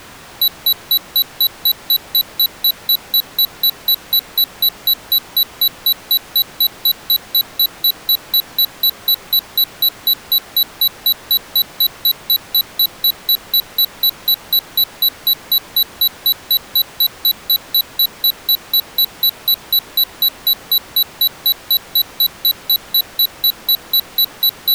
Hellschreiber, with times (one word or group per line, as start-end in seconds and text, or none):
none